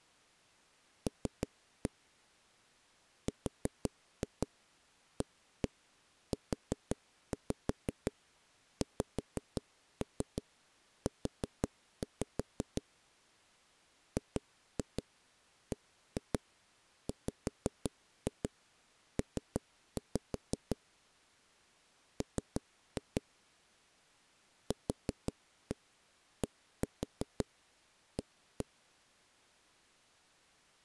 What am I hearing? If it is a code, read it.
Tap code, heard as knocks on a wall, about 5 knocks a second. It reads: L RAUXU GBWP M QDA